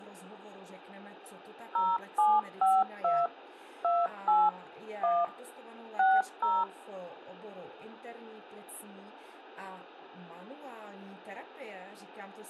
DTMF, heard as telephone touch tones, dialled by machine, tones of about 210 ms. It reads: 0752 28 1 60